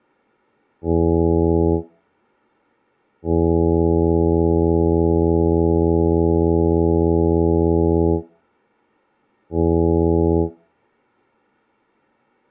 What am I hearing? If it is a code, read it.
Ship horn signal, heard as a ship's horn, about 80 Hz. 1 short, 1 long, 1 short. At sea: a vessel at anchor warns of its position.